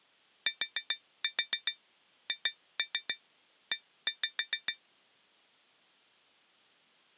Tap code, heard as taps on glass, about 7 knocks a second. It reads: THE